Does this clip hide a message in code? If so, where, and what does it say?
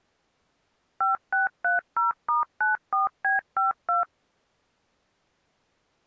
Yes: DTMF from 1.0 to 4.0 s, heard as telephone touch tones, dialled by machine, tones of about 140 ms. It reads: 5630*94B52